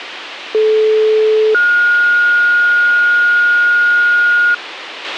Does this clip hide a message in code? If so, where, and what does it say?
Yes: two-tone page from 0.5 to 4.5 s, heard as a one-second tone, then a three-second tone, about 430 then 1430 Hz, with radio hiss and a squelch burst at the end.